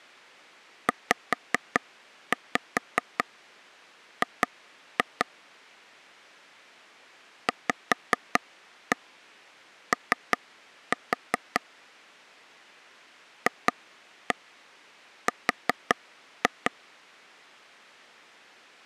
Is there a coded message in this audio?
Yes: tap code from 0.9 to 16.7 s, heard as taps on a table, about 5 knocks a second. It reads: ZG VO FR